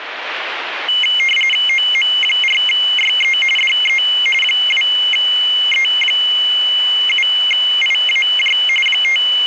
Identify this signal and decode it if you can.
RTTY (45.45 baud, 850 Hz shift), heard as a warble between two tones, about 2550 Hz centre, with radio static. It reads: OM4YE DE 2E7IAJ …